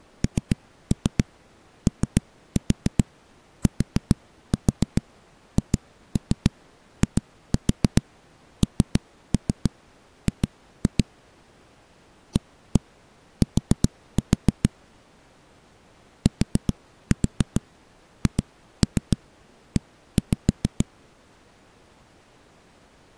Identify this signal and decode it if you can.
Tap code, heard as knocks on a wall, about 7 knocks a second. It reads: NOTHING AT THE